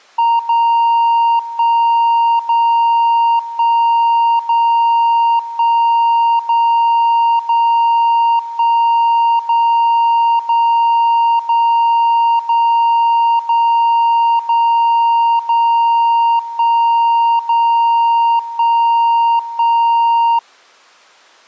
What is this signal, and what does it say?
Radio time signal (DCF77), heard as a tone whose level steps once a second, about 930 Hz. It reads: 0 1 0 1 0 1 0 0 1 0 0 0 0 0 0 0 1 0 1 1